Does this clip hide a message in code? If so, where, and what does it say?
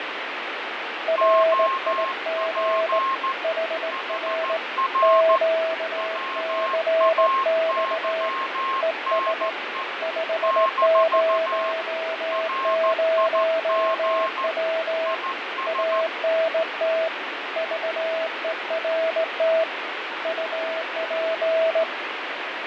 Yes: Morse code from 1.0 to 21.9 s, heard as two keyed tones, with heavy radio static and fading. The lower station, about 18 wpm, 650 Hz: RIG HR QCX ES 500W ANT VERT UP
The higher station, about 14 wpm, 1070 Hz: OP HR WAYNE - RIG IS